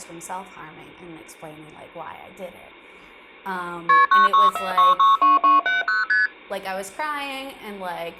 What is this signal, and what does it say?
Multi-frequency trunk signalling (R1, as on North American trunks), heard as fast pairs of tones, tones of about 160 ms, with speech in English. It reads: KP 964662270 ST